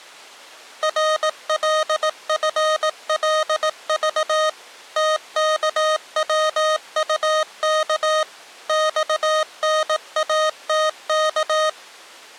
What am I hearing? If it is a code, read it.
Morse code, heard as electronic beeps, machine-sent, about 18 wpm, 620 Hz. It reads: RLFLV TKWUK XNATK